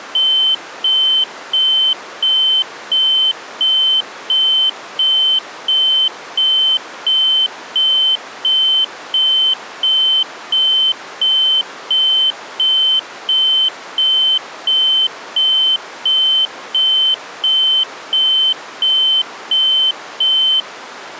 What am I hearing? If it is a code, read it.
Evenly repeated beeps. There is no code.